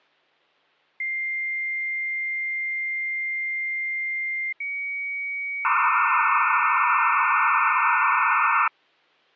Dial-up modem handshake (low-speed, two carriers), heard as two whistles, then hiss.